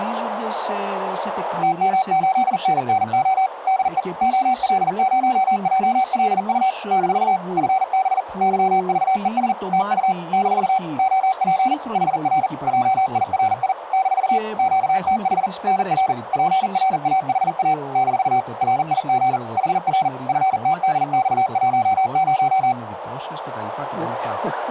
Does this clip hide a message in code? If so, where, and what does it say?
Yes: Morse code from 1.6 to 22.8 s, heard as a keyed tone, machine-sent, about 40 wpm, 760 Hz, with radio static, a narrow filter and speech in Greek. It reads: TM8NNO DE OL0JLU - FB YVES TU - OP HR JIRI - QTH NR PRAHA - RIG HR FTDX10